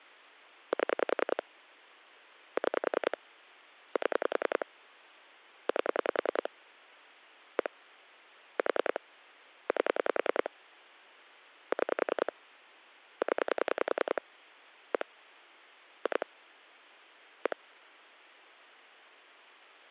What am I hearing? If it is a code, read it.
Pulse dialling, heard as clicks on a phone line, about 10 pulses a second. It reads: 7 6 7 8 1 4 8 6 0 1 2 1